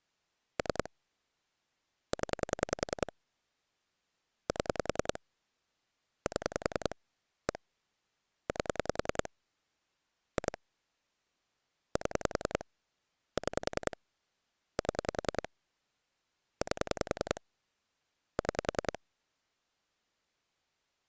Pulse dialling, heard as clicks on a phone line, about 10 pulses a second. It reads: 3 0 7 7 1 8 2 7 6 7 8 6